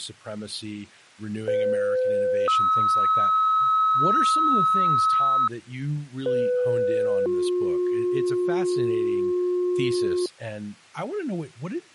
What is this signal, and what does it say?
Two-tone page, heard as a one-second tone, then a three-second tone, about 510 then 1290 Hz, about 500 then 360 Hz, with speech in English.